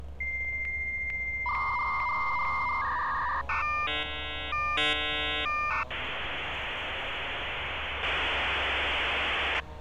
Dial-up modem handshake (V.34 or later), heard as a whistle, warbles, then hiss, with street noise.